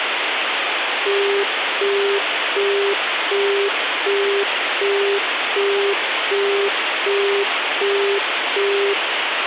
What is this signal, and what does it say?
Telephone call progress tone (as in the UK, Australia and similar networks), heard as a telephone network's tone, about 400 Hz, 0.375 s on and 0.375 s off, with phone line noise. Busy tone.